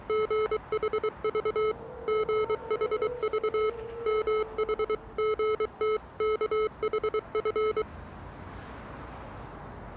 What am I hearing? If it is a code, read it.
Morse code (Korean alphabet), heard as electronic beeps, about 23 wpm, 430 Hz, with street noise. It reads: 술 술 무서운